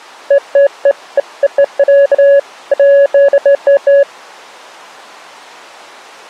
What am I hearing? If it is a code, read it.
Beeps of irregular length. There is no code.